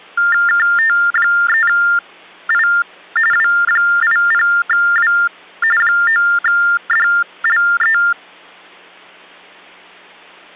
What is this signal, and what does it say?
TTY/TDD text telephone tones (45.45 baud Baudot), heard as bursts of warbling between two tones, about 400 Hz shift, 1600 Hz centre. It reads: KT3I W80W 9DLE